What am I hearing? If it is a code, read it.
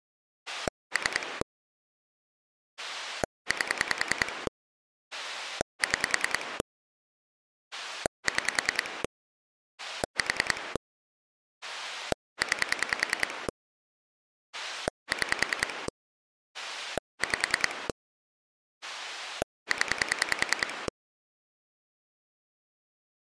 Pulse dialling, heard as a rotary dial, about 10 pulses a second. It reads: 3 8 6 6 4 9 6 5 0